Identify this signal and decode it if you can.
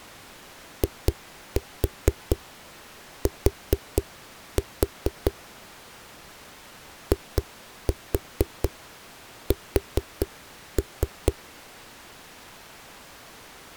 Tap code, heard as knocks on a wall, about 4 knocks a second. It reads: IT IS